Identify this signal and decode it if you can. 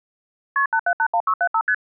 Multi-frequency trunk signalling (R1, as on North American trunks), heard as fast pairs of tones, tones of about 70 ms. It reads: KP 8781675 ST